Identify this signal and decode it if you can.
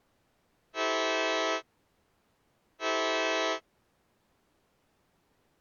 Train horn signal, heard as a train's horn. 2 short. On North American railways: a signal is acknowledged.